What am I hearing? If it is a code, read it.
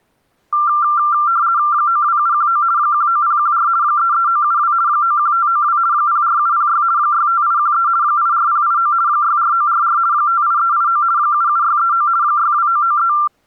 RTTY (50 baud, 170 Hz shift), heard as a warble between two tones, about 1280 Hz centre. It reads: 92719 19014 33972 91592 04706 65813 84089 64944 58389 77639 62993